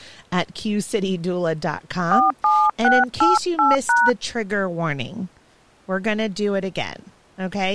DTMF, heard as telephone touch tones, dialled by hand, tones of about 210 ms, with speech in English. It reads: 47688#